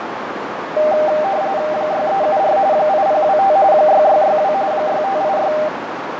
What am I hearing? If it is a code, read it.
RTTY (45.45 baud, 170 Hz shift), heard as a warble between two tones, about 700 Hz centre, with radio static, fading and a narrow filter. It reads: 6374 8025 6662 6586